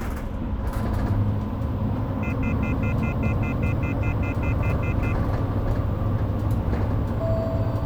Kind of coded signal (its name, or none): telephone call progress tone